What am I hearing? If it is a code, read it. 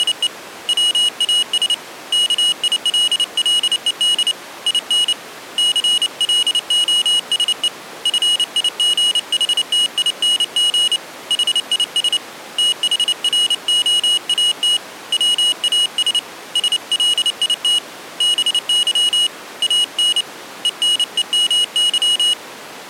Morse code, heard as a high beeper, hand-sent with a paddle, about 29 wpm, 2900 Hz. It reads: … WAS KILLED IN CLOSE FIGHTING HIS THROAT WAS SLIT BY AN ENEMY